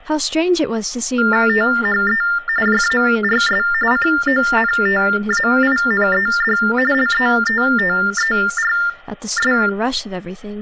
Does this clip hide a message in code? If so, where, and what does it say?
Yes: TTY/TDD text telephone tones (45.45 baud Baudot) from 1.2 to 9.7 s, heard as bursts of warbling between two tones, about 400 Hz shift, 1600 Hz centre, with room echo and speech in English. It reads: THE JARS CONTAINED LETTERS